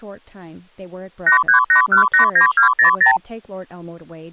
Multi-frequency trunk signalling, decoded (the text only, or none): 838189200